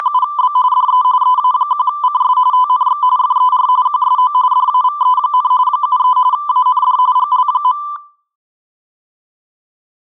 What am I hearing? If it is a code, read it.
RTTY (45.45 baud, 170 Hz shift), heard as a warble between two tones, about 1090 Hz centre, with room echo. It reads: … DE EA1CS TNX FER QSO DAVE, 73 AND GL.